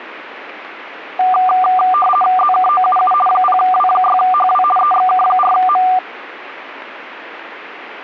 RTTY (50 baud, 450 Hz shift), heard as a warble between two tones, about 970 Hz centre. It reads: ZKOUU 0W6HW EXK4M